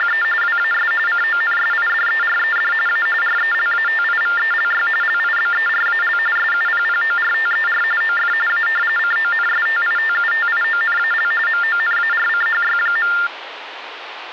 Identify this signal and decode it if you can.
TTY/TDD text telephone tones (45.45 baud Baudot), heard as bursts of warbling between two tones, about 400 Hz shift, 1600 Hz centre, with phone line noise. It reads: … WAS CONSIDERED A RELATIVELY LIBERAL SUPPORTER OF A CONSTITUTIONAL MONARCHY.